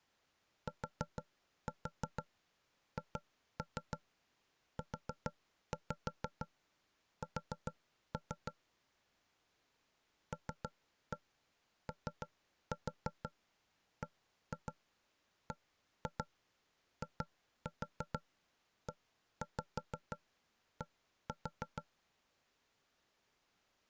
Tap code, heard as knocks on wood, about 6 knocks a second. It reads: THUS LOBBIED